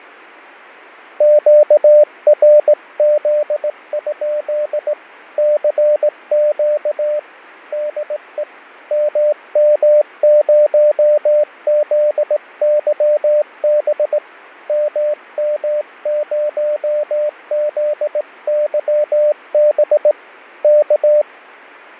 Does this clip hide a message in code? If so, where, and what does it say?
Yes: Morse code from 1.1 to 21.3 s, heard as a keyed tone, hand-sent with a straight key, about 18 wpm, 600 Hz, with fading. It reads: QRZ? CQ DE MM0ZYB MM0ZYB K